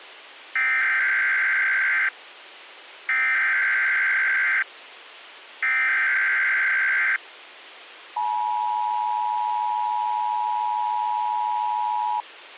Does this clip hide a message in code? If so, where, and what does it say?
Yes: Emergency Alert System (SAME) tones (header bursts, then the 853 and 960 Hz attention tone) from 0.6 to 12.2 s, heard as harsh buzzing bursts, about 520.83 baud.